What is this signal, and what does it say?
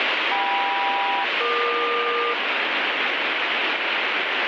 Aircraft SELCAL, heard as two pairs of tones, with heavy radio static. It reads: KM-EQ